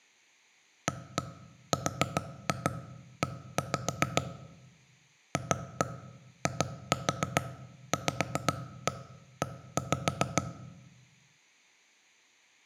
Tap code, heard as knocks on wood, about 7 knocks a second, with room echo. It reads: ARE FIVE